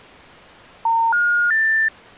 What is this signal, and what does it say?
Telephone call progress tone (North American plan), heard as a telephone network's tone, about 910, 1430, 1800 Hz. Special information tone.